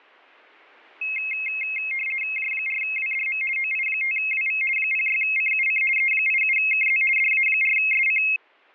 RTTY (50 baud, 450 Hz shift), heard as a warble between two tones, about 2350 Hz centre. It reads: J4WDM OI5WV 06CUC E87KZ DA4SC